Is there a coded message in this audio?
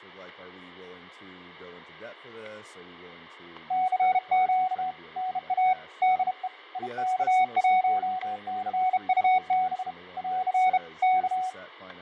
Yes: Morse code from 3.6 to 11.6 s, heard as a keyed tone, hand-sent with a bug key, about 32 wpm, 740 Hz, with fading, static crashes and speech in English. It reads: CQ NA DE IK1CUB <AR> K